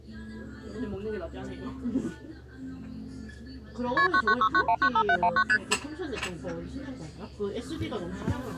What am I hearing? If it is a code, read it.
Multi-frequency trunk signalling (R1, as on North American trunks), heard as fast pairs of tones, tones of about 70 ms, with the noise of a cafe. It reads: KP 9969195719 ST